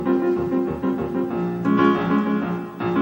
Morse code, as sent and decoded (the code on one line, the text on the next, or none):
none